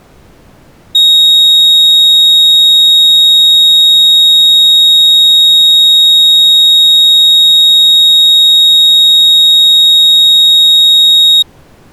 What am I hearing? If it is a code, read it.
A steady tone. There is no code.